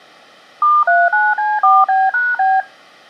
DTMF, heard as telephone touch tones, dialled by machine, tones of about 210 ms. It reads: *39C4B#B